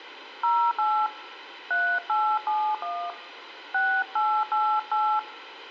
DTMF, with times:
0.4-1.1 08
1.7-3.1 3871
3.7-5.2 6888

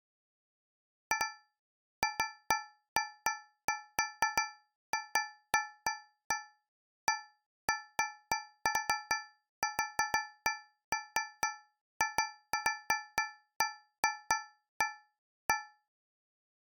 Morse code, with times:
none

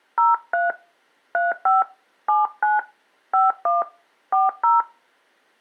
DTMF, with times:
0.2-0.7 03
1.3-1.8 35
2.3-2.8 79
3.3-3.8 51
4.3-4.8 40

